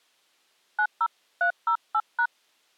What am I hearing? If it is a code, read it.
DTMF, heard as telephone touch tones, dialled by hand, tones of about 70 ms. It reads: 90308#